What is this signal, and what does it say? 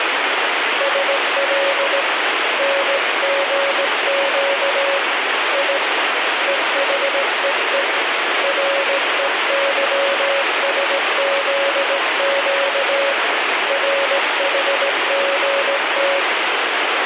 Morse code, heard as a keyed tone, hand-sent with a straight key, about 17 wpm, 560 Hz, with heavy radio static. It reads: SL NGQ I EHEE REYSZQ RHGT